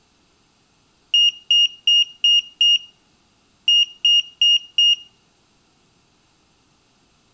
Beep code, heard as a piezo beeper, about 2850 Hz, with room echo. 5-4.